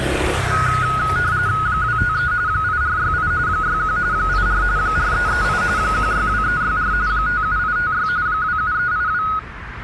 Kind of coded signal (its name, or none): RTTY